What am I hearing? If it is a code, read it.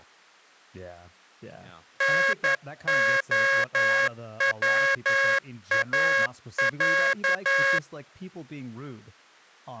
Morse code (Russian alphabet), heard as a buzzer, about 11 wpm, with speech in English. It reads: НОВАЯ